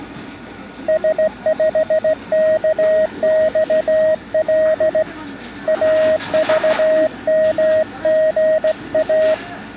Morse code, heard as a keyed tone, hand-sent with a straight key, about 16 wpm, 630 Hz, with the noise of a cafe. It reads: S5KXL AVMGA